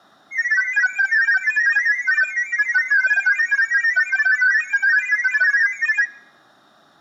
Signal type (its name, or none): multi-tone FSK (Olivia or MFSK type)